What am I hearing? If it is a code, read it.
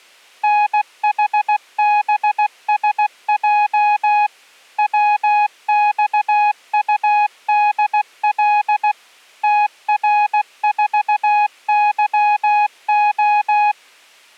Morse code, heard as a keyed tone, machine-sent, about 16 wpm, 830 Hz. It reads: NHBSJ WXUDL TR4YO